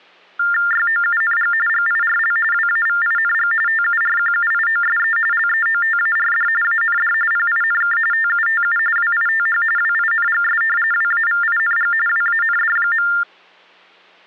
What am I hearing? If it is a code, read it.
TTY/TDD text telephone tones (45.45 baud Baudot), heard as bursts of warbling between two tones, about 400 Hz shift, 1600 Hz centre. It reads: YOUNG GIRL WAVING TURQUIOSE LEOTARD AND PINK TUTU WITH WINGS WAVING WAND.